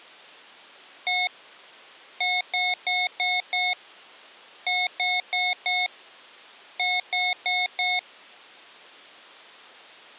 Beep code, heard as beeps from a small speaker, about 730 Hz. 1-5-4-4.